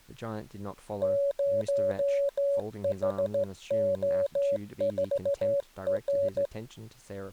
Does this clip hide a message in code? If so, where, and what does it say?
Yes: Morse code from 1.0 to 6.5 s, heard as a keyed tone, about 15 wpm, 560 Hz, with speech in English. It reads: 0HO4R